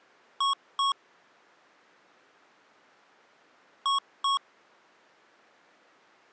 Beep code, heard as beeps from a small speaker, played twice, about 1100 Hz. 2 short. In AMI BIOS tables: memory parity error; in IBM BIOS tables: self-test error shown on screen; in Dell tables: no memory detected.